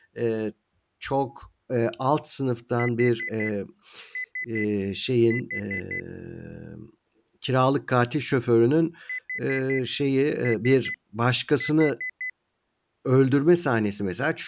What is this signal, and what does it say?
Beep code, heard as beeps from a small speaker, played twice, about 2000 Hz, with speech in Turkish. 4-3-4. In Phoenix BIOS tables: time-of-day clock failure.